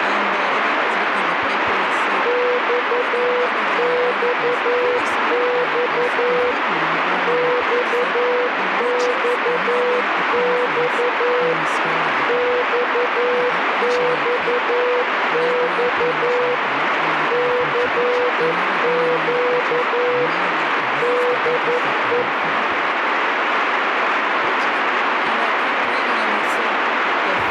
Morse code, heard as a keyed tone, machine-sent, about 11 wpm, 490 Hz, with radio static. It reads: XXX XXX XXX CQ DE